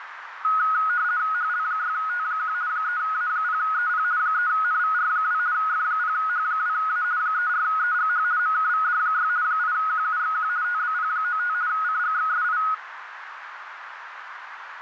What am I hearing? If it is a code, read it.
RTTY (50 baud, 170 Hz shift), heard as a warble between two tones, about 1360 Hz centre, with radio static and a narrow filter. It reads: HL6T1 3A0EP 3NVR2 F0H2A 34EGH MKVD6 8QUXQ TBP95 CGXSI